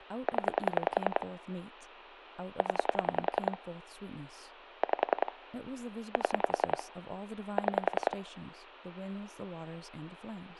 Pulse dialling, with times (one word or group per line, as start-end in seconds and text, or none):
0.3-1.3 0
2.6-3.6 0
4.8-5.3 5
6.1-6.8 7
7.6-8.2 6